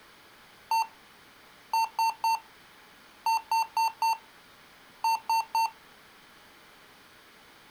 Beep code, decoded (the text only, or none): 1-3-4-3